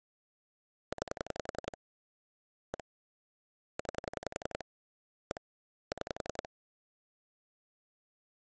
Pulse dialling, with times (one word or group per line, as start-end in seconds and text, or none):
0.9-1.8 9
2.7-2.8 1
3.8-4.6 9
5.3-5.4 1
5.9-6.5 6